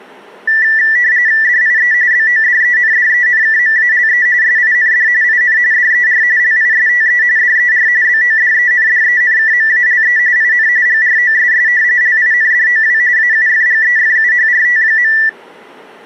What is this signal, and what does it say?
RTTY (45.45 baud, 170 Hz shift), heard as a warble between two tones, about 1850 Hz centre. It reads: DIE BODENDENKMALE SIND IN DER LISTE DER BODENDENKMALE IN GROSS LINDOW AUFGEFUHRT.